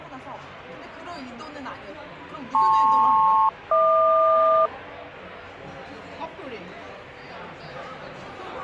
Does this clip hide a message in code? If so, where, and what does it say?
Yes: aircraft SELCAL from 2.5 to 4.7 s, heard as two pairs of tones, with the noise of a crowd indoors. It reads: LP-HQ